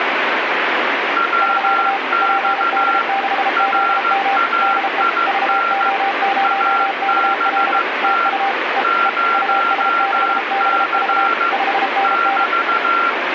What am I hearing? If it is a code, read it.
Morse code, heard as two keyed tones, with radio static. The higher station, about 15 wpm, 1370 Hz: WX RAIN ABT 0C <BT>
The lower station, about 33 wpm, 790 Hz: <SK> PD6ZM DE VO0KL TU E E US6BV 5NN